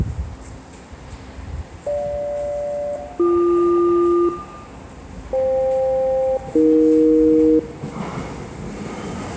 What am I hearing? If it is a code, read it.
Aircraft SELCAL, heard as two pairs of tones, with room echo and the noise of a subway station. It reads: GJ-BQ FK-AE